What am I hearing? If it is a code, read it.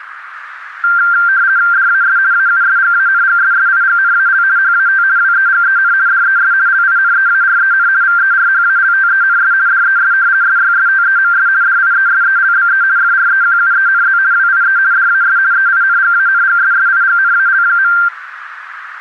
RTTY (50 baud, 170 Hz shift), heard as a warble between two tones, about 1480 Hz centre, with radio static and a narrow filter. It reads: DAS AUSGANGSSIGNAL HAT WEGEN DES LINEAREN VERHALTENS DES SYSTEMS DIESELBE FREQUENZ WIE DAS EINGANGSSIGNAL.